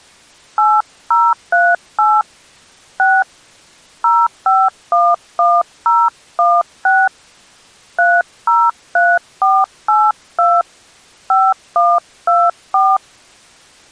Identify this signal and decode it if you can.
DTMF, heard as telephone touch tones, dialled by hand, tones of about 230 ms. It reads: 8038 6 0511016 303482 5124